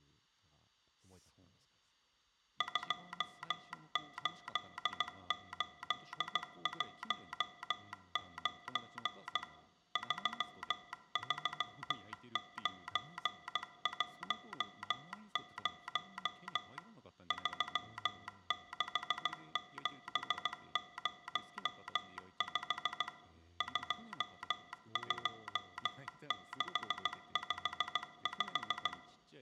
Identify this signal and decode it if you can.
Morse code, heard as a telegraph sounder, machine-sent, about 16 wpm, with room echo and speech in Japanese. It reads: 28819 33910 36705 22655